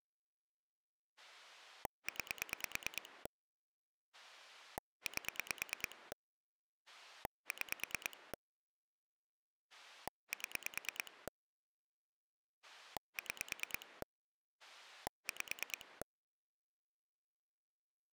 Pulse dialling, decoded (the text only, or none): 9 8 6 7 6 5